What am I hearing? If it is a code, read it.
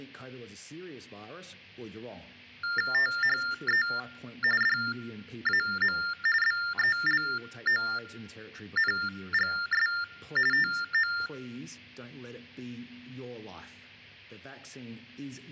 TTY/TDD text telephone tones (45.45 baud Baudot), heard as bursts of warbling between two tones, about 400 Hz shift, 1600 Hz centre. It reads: THE DAM BELONGS TO